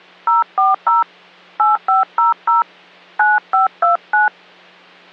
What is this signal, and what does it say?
DTMF, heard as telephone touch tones, dialled by hand, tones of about 160 ms, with hum. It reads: 040 8500 9529